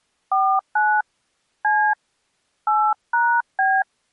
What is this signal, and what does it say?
DTMF, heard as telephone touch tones, dialled by hand, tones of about 280 ms. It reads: 49 C 8#B